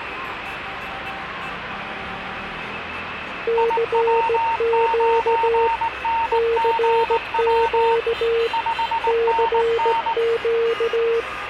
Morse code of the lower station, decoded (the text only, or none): CQ CQ CQ